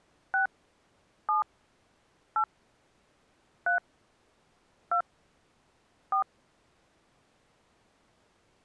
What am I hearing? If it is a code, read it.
DTMF, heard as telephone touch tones, dialled by hand, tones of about 100 ms. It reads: 6 7 8 3 2 4